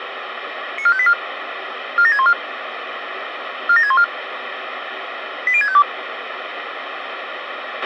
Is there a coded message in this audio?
Yes: five-tone selective call (ZVEI) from 0.8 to 5.8 s, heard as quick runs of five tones, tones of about 70 ms, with radio hiss and a squelch burst at the end. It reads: 94584 47614 47614 80652